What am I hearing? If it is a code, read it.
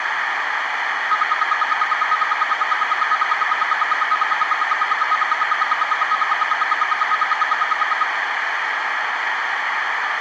Radio time signal (RWM, Moscow), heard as ten pulses a second, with radio static, a narrow filter and room echo.